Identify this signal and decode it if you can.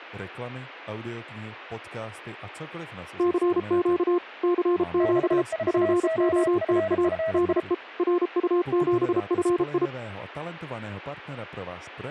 Morse code, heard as two keyed tones. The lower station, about 33 wpm, 350 Hz: CQ CQ POTA DE RU7FI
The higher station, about 33 wpm, 650 Hz: 64OFFI